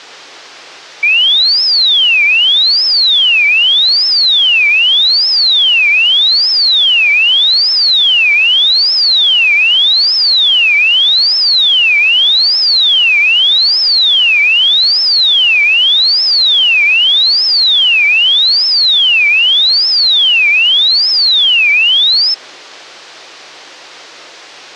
A tone that sweeps in pitch again and again, with hum. There is no code.